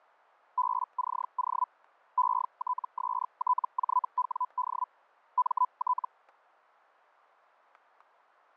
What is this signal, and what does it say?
Hellschreiber (Feld-Hell, 122.5 baud), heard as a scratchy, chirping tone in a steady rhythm, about 1000 Hz, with static crashes. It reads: BCO ETSTJWD MT